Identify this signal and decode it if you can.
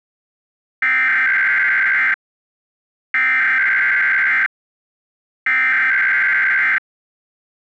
Emergency Alert System (SAME) tones (header bursts), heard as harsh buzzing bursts, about 520.83 baud.